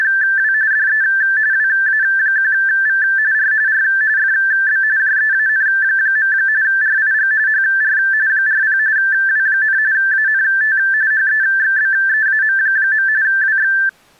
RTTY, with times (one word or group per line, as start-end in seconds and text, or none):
0.0-0.5 …
0.7-1.0 DE
1.5-3.0 WA1V
3.3-3.5 R
3.7-3.8 R
4.2-4.8 FB
5.0-6.3 JEAN.
6.6-7.3 RIG
7.5-8.0 HR
8.3-8.8 40
9.0-9.8 W,
9.9-10.8 ANT
11.1-13.1 HEXBEAM.
13.2-13.7 WX